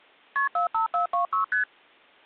Multi-frequency trunk signalling (R1, as on North American trunks), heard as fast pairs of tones, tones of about 120 ms. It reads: KP 45426 ST